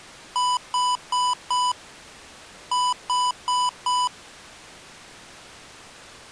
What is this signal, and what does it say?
Beep code, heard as beeps from a small speaker, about 990 Hz. 4-4.